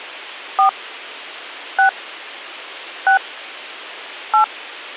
DTMF, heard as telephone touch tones, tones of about 110 ms. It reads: 4 6 6 8